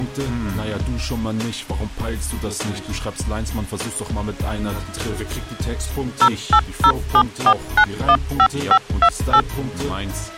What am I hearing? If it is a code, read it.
DTMF, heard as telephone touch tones, dialled by machine, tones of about 70 ms. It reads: 08074915528